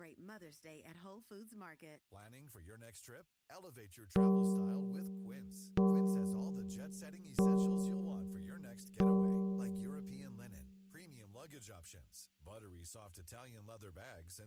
Clock strike, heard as a bell, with speech in French. 4. Four o'clock.